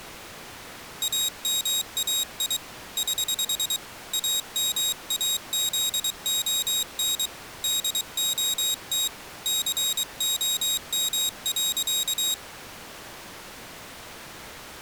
Morse code, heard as a high beeper, hand-sent with a paddle, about 23 wpm, 3800 Hz. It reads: AMAI <HH> AMAZON DOT COM.